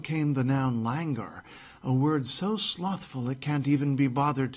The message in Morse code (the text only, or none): none